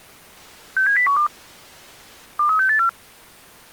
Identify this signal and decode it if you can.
Five-tone selective call (CCIR), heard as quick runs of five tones, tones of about 100 ms. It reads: 67012 23684